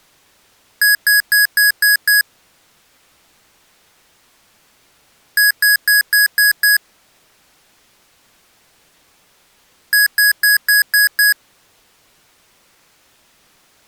Beep code, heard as beeps from a small speaker, played three times, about 1650 Hz. 6 short. In AMI BIOS tables: keyboard controller gate A20 failure; in Dell tables: video card failure.